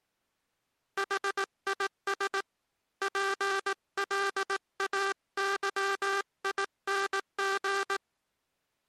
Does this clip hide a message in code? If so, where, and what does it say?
Yes: Morse code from 0.9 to 8.0 s, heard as a buzzer, hand-sent with a paddle, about 18 wpm. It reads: HIS PLAYING